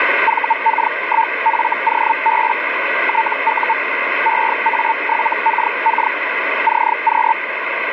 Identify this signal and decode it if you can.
Hellschreiber (Feld-Hell, 122.5 baud), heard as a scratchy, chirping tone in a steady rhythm, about 900 Hz, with radio static. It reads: VK1FOB TU EA7KK CQ